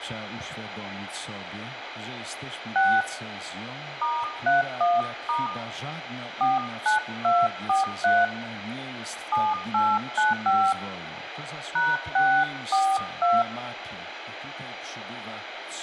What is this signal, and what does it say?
DTMF, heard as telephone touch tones, dialled by hand, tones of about 200 ms, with phone line noise and room echo. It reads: 6 *31* 49243 7895 #642